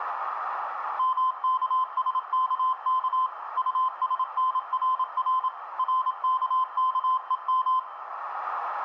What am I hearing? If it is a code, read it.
Morse code, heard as a keyed tone, machine-sent, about 27 wpm, 1030 Hz, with radio static, a narrow filter and room echo. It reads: MKSKK USNRR RKKEM